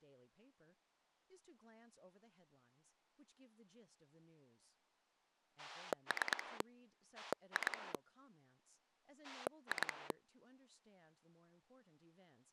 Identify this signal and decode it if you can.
Pulse dialling, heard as a rotary dial, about 9 pulses a second, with speech in English. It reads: 3 2 2